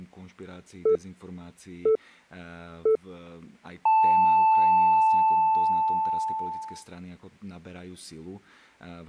Radio time signal (three low pips and a long one an octave up, as on NHK), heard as pips, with speech in Czech.